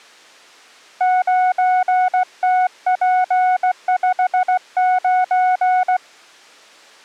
Morse code, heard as a keyed tone, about 16 wpm, 740 Hz. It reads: 9TP59